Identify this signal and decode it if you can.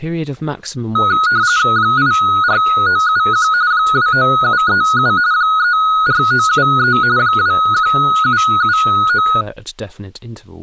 RTTY (45.45 baud, 170 Hz shift), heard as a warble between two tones, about 1360 Hz centre, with speech in English. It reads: 84971 29737 34973 21779